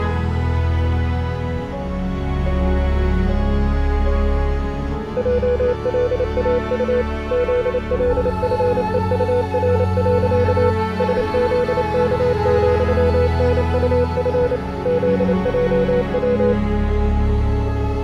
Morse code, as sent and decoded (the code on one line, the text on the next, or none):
.--- .-.. .- ..- / --.. .-.. ..-. . ..- .-. .-.-.- / ... --.. -.- --..-- -. ..- ..-. / --.. .--- .--
JLAU ZLFEUR. SZK,NUF ZJW